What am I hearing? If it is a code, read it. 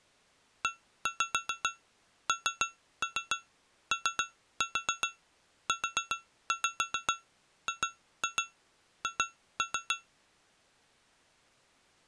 Tap code, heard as taps on glass, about 7 knocks a second. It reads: ENOUGH